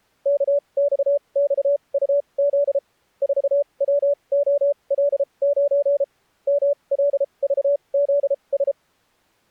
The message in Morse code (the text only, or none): KXXUZ 4WOL9 MLVZS